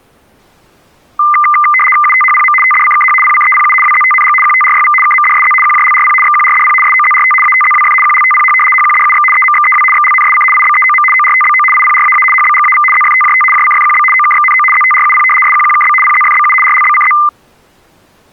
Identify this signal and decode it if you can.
RTTY (75 baud, 850 Hz shift), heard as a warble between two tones, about 1600 Hz centre. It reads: UTHPM TDCKH PCEPU WZTNG QTRYV KMDSZ QJLRP XQRDP SOZRT ATZWF QLTPH HQDUX EMXEW XLNSC IBEOM ORTBO IPRAA HBGAV ZFTJT JCFQB OKXNO ZTRUP SQQKB PZFBU RLBCZ